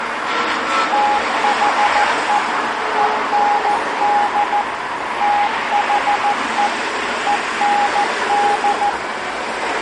Morse code, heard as a keyed tone, machine-sent, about 14 wpm, 820 Hz, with street noise. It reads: THE END THE END